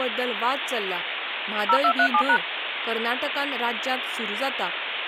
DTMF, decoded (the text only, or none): 0237#